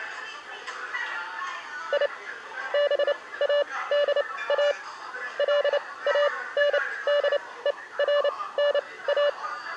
Morse code, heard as a keyed tone, machine-sent, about 29 wpm, spaced as for 19 wpm, 580 Hz, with the noise of a crowd indoors. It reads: I BADA LANDERNA